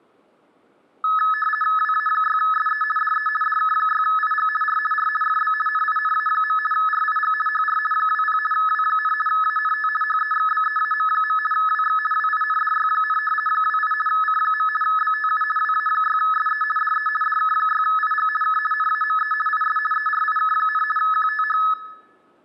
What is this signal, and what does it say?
RTTY (50 baud, 450 Hz shift), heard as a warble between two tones, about 1500 Hz centre, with room echo. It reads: WA6SE DE DK6IG R R FB NINA. RIG HR 20 W, ANT HEXBEAM. WX WINDY, 28 C. BTU WA6SE DE DK6IG K NAME IS ERIK, QTH